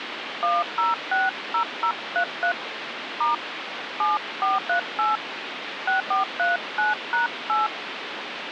DTMF, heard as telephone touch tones, dialled by hand, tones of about 140 ms, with phone line noise. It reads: 1060033 * 7438 6439#8